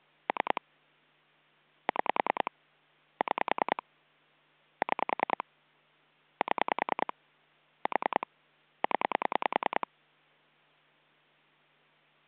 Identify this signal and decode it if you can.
Pulse dialling, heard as clicks on a phone line, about 10 pulses a second. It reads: 3 6 6 6 7 4 0